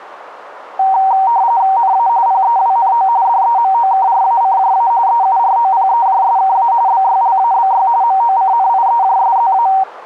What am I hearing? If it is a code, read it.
RTTY (45.45 baud, 170 Hz shift), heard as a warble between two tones, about 850 Hz centre, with radio static. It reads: NA PEWNO DEMOKRACJA EUROPEJSKA BYLABY MOCNIEJSZA